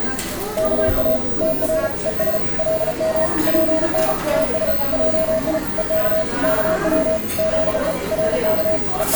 Morse code, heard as a keyed tone, hand-sent with a paddle, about 35 wpm, 640 Hz, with the noise of a cafe. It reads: KA TR ES LM PN TS JI EK KW ZE RK …